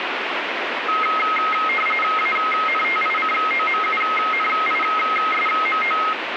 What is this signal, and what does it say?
RTTY (45.45 baud, 850 Hz shift), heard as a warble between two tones, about 1700 Hz centre, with radio static. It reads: ANTICOMUNISMO